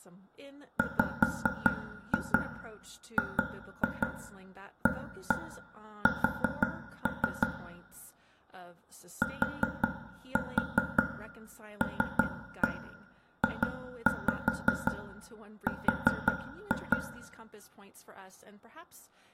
Tap code, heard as taps on a table, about 5 knocks a second, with room echo and speech in English. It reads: WGAS TLJR